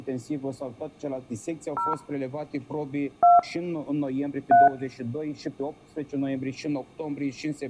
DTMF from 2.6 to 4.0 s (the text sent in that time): 2